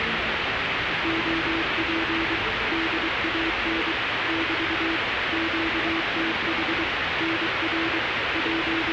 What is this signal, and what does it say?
Morse code, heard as a keyed tone, machine-sent, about 23 wpm, 330 Hz, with radio static and the noise inside a subway train. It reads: OP DAN <BT> QTH NR …